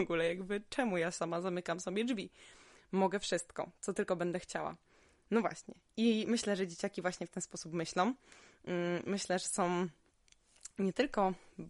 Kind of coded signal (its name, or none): none